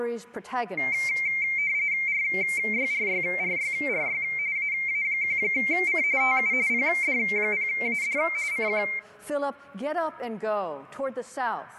RTTY (45.45 baud, 170 Hz shift), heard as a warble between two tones, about 2200 Hz centre. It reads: RYRYRYRY AA1C TU PD0AD CQ